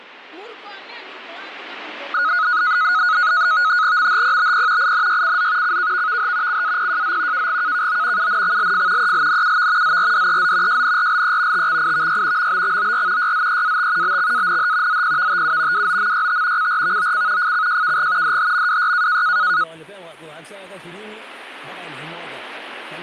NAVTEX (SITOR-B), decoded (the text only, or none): MHPBP INYCZ CKVVH CAPJZ KGKKO UNXLF ELNUV ZRDEZ JNRLE TXIVY MBXOR YZEAT BXANH ZPVTU WOMYT CRVOC FCJKG DHMWY